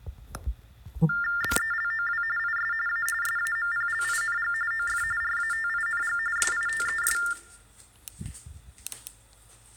TTY/TDD text telephone tones (45.45 baud Baudot), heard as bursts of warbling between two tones, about 400 Hz shift, 1600 Hz centre, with kitchen noise. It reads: BELOW IS A SAMPLING OF RATING SITES